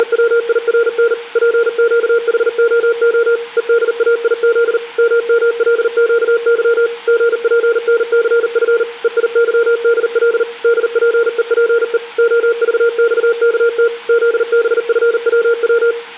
Morse code, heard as a keyed tone, machine-sent, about 39 wpm, 470 Hz, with room echo. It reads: … PQHOO EDAIZ MMLQY GPNCF EIYDL DPEPE OVXKT ZBFWW